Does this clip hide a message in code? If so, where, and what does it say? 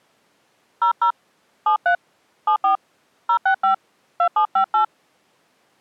Yes: DTMF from 0.8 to 4.8 s, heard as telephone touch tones, dialled by hand, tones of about 100 ms. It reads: 00 73 74 065 2758